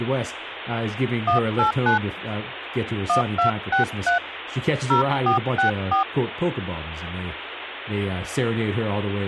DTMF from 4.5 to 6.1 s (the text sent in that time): 0464